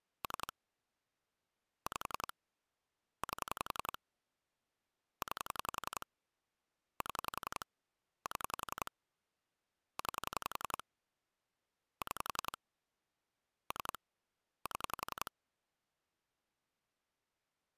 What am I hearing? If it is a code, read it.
Pulse dialling, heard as clicks on a phone line, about 11 pulses a second. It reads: 3 5 8 9 7 7 9 6 3 7